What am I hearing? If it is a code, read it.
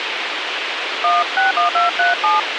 DTMF, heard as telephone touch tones, dialled by hand, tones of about 170 ms, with radio hiss. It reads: 161237